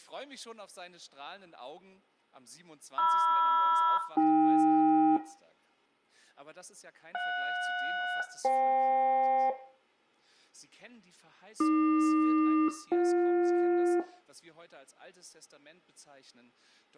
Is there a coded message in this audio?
Yes: aircraft SELCAL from 3.0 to 14.0 s, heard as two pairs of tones, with room echo. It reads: MR-AK JS-FK AQ-BJ